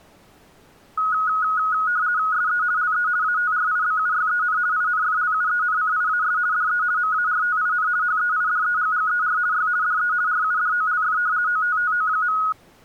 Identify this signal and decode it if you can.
RTTY (50 baud, 170 Hz shift), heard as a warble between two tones, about 1360 Hz centre. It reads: SE LE ATRIBUYEN INFLUENCIAS DE MARTIN HEIDEGGER Y DE RUDOLF OTTO.